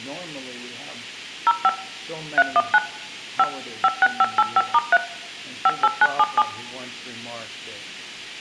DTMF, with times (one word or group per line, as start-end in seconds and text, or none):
1.5-1.7 05
2.4-2.8 319
3.4-3.4 5
3.8-5.0 56585*3
5.7-6.4 58977